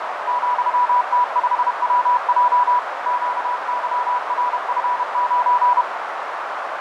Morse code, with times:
0.3-2.8 ,T5WJ
3.1-5.8 QYRF9

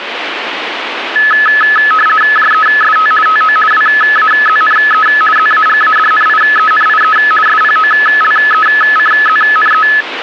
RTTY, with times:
2.4-3.1 JEST
3.3-3.6 TO
3.7-5.1 WAZNE
5.4-7.2 ZAGADNIENIE
7.5-9.9 SPOLECZNE

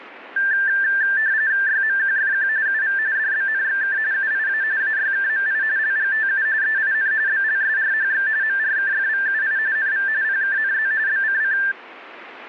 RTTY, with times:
1.7-2.5 YMQFQ
2.7-3.0 UV
3.2-4.0 DBNXK
4.1-4.6 UIA
4.8-5.6 AYKMI
5.8-6.5 LGTU
6.6-7.1 EIN
7.3-8.3 BLSRHX
8.4-9.6 MRKFVUI
9.8-10.1 NV
10.2-10.9 PKNZ
11.1-11.6 BCC

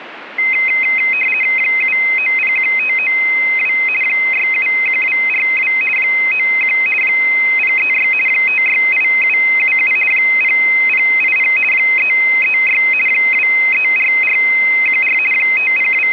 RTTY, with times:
1.6-3.7 7901592
4.0-5.7 671242
6.0-6.8 91
7.0-8.1 036
8.3-9.9 568777
10.1-11.5 0080
11.7-12.8 336
13.1-15.2 234414
15.3-16.1 …

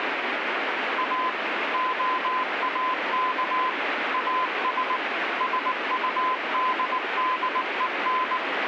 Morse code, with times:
1.0-1.3 A
1.7-3.7 OAK
4.1-5.0 AS
5.4-8.4 SUDDEN

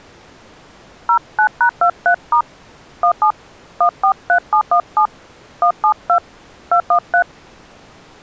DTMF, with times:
1.1-2.4 09#23*
3.0-3.3 17
3.8-5.1 143717
5.6-6.2 172
6.7-7.2 213

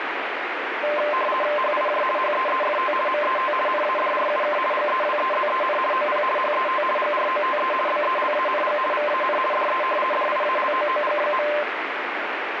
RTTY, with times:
1.6-2.0 HIJ
2.2-2.9 HEEFT
3.1-3.5 MET
3.7-4.6 NADRUK
4.7-5.8 GEWEZEN
5.9-6.2 OP
6.4-6.8 HET
7.0-7.7 GROTE
7.9-8.8 BELANG
8.9-9.4 VAN
9.5-9.8 DE
10.1-11.5 DIALOOG.

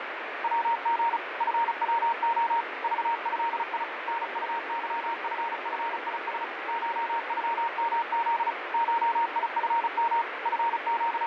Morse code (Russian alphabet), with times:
0.4-1.2 ВГ
1.4-2.6 ФВО
2.8-3.8 ЖЭИ
4.1-6.4 НУЫФФИС
6.7-8.5 ШЮМЗ
8.7-10.2 ШИФМ
10.5-11.3 …

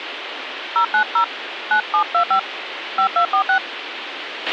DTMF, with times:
0.8-1.2 090
1.7-2.4 9725
3.0-3.6 5246

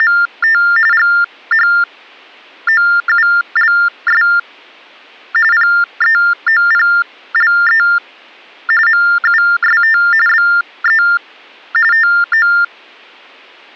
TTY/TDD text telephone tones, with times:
0.0-0.6 …
0.9-4.2 GHOULS
5.5-7.8 PEOPLE
8.9-10.0 MUST
10.3-11.0 BE
11.9-12.5 TO

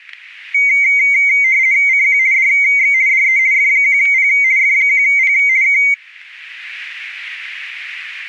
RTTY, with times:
1.9-2.2 CQ
2.3-2.9 DX
3.1-3.4 DE
3.5-4.3 F1P
4.6-5.3 F1P
5.6-5.8 K

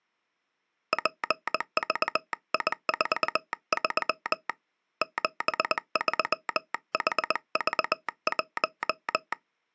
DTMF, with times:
none

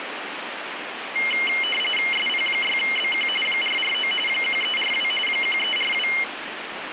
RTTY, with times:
2.1-3.3 SP6BQ
3.5-4.1 449
4.3-5.1 1342
5.3-6.1 1342

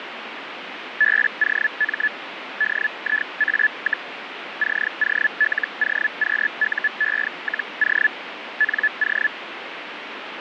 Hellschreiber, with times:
1.0-2.1 BOM
2.6-4.1 DIA,
4.6-8.1 COLOQUE-O
8.6-9.3 NO

